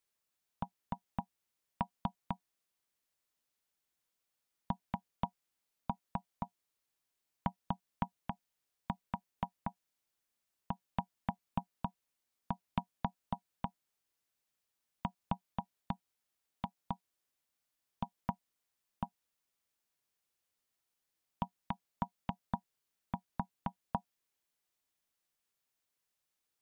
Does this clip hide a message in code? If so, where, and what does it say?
Yes: tap code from 0.6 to 24.0 s, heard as knocks on wood, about 4 knocks a second. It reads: N NTZRF Y